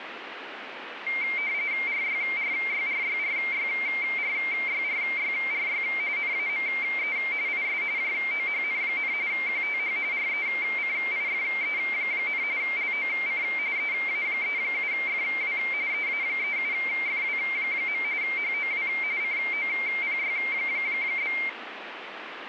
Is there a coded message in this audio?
Yes: RTTY (45.45 baud, 170 Hz shift) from 1.1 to 21.5 s, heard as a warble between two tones, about 2200 Hz centre, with radio static. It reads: RYRYRYRYRYRYRY NAME IS JOHN, QTH RECIFE, LOC EA37FW EA37FW. HOW COPY?